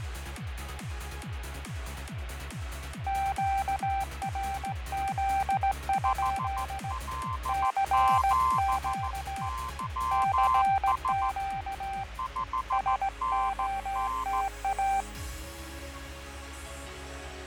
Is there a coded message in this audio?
Yes: Morse code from 3.0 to 15.1 s, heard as two keyed tones, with radio static and fading. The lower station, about 17 wpm, 780 Hz: QRZ? CQ CQ SOTA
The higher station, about 14 wpm, 1040 Hz: HL7YS 5NN